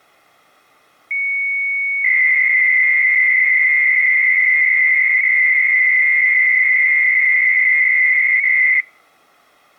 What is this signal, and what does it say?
300-baud modem data (Bell 103 tones), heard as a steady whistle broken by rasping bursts, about 300 baud, 200 Hz shift.